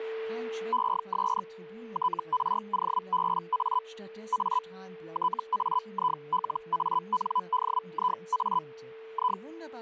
Hellschreiber (Feld-Hell, 122.5 baud), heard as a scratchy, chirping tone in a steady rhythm, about 1000 Hz, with a steady whistle near 450 Hz and speech in German. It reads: ES TROBA A TAILANDIA I